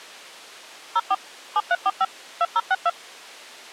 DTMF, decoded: 04 7345 2062

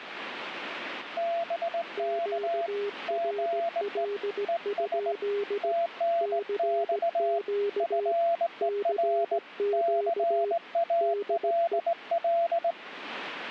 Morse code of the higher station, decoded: BK GE ES TNX FER CALL

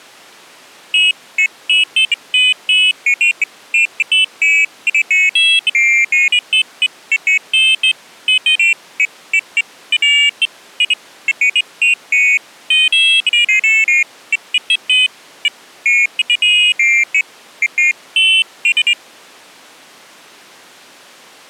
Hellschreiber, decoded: none

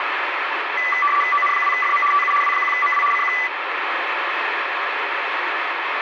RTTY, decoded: ON2FM TU W1MW CQ

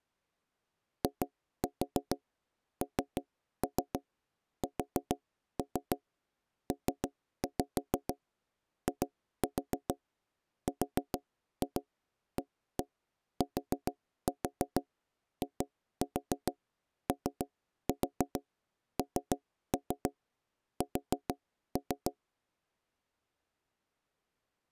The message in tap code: INSPIRATIONS

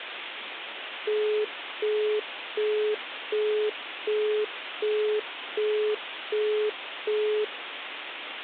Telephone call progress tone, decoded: busy tone

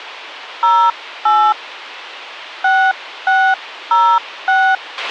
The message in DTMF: 08 6606

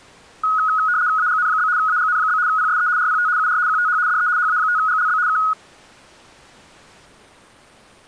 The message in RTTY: AGN? AGN? PSE RPT UR QTH DE HA5GLB K

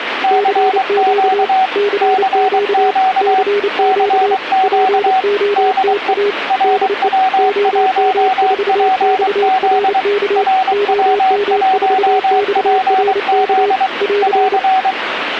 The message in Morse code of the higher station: CQ CQ CQ DE RW1PZ RW1PZ <AR>

